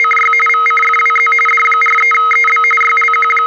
RTTY (45.45 baud, 850 Hz shift), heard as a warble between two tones, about 1700 Hz centre, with a steady whistle near 470 Hz. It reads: … VCFWZ D43EB …